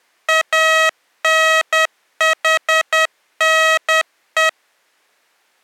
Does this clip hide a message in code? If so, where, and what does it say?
Yes: Morse code (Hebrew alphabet) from 0.2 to 4.6 s, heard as electronic beeps, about 10 wpm, 640 Hz. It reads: אנחנו